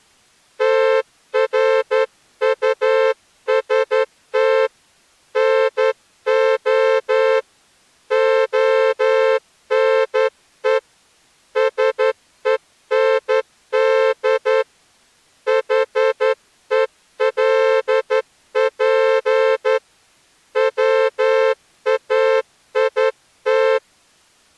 Morse code, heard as a horn, hand-sent with a straight key, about 11 wpm. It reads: TRUST NO ONE SEND HELP WAIT